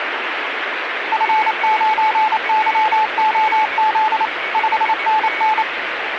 Morse code, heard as a keyed tone, machine-sent, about 28 wpm, 870 Hz, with radio static and a weaker station near 2230 Hz. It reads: F9YOZ 5NN